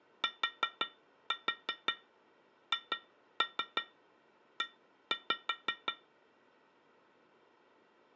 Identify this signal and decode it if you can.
Tap code, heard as taps on glass, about 5 knocks a second. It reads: THE